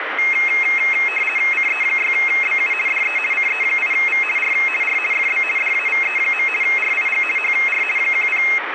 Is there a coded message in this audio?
Yes: RTTY (50 baud, 450 Hz shift) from 0.2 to 8.6 s, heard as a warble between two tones, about 2350 Hz centre, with radio static. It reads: CE6BU DE CE8V R R FB DAVE. RIG HR 10